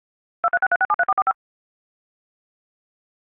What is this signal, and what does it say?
DTMF, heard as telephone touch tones, dialled by machine, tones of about 40 ms. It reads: 2363673445